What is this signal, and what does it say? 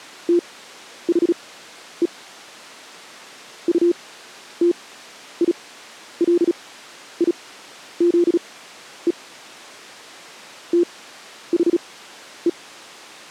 Morse code, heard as a keyed tone, machine-sent, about 36 wpm, spaced as for 11 wpm, 350 Hz. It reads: THE UTILIZE THE